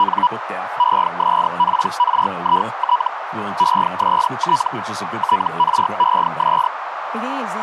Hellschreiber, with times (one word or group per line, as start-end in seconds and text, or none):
0.0-0.3 …
0.8-3.1 ESPRIT
3.6-4.7 EST
5.2-6.7 TRES